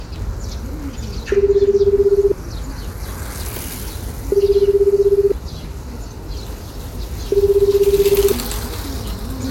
Telephone call progress tone (Japanese plan), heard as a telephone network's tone, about 380, 400, 420 Hz, 1 s on and 2 s off, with the noise of a park. Ringback tone.